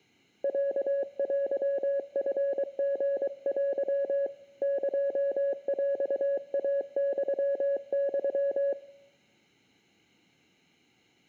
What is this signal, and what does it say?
Morse code (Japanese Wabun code), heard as a keyed tone, hand-sent with a paddle, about 23 wpm, 560 Hz, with room echo. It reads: ロテチリテ エヰイユユ